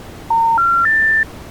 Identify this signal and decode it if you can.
Telephone call progress tone (North American plan), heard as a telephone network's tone, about 910, 1370, 1800 Hz. Special information tone.